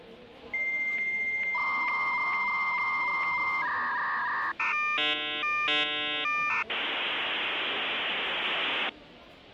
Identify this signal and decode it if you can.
Dial-up modem handshake (V.34 or later), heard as a whistle, warbles, then hiss, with the noise of a cafe.